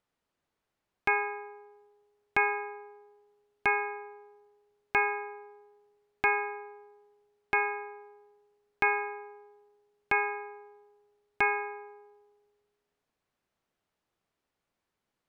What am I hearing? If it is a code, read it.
Clock strike, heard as a bell. 9. Nine o'clock.